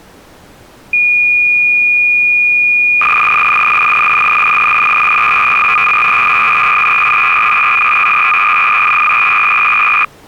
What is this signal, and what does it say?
Cassette data (Kansas City type), 300 baud, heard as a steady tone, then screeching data.